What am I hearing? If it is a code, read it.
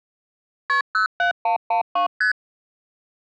Multi-frequency trunk signalling (R1, as on North American trunks), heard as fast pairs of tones, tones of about 110 ms. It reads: KP 07112 ST